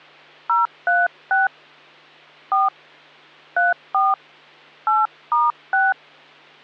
DTMF, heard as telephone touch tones, dialled by hand, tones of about 180 ms, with hum. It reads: 036 4 34 8*6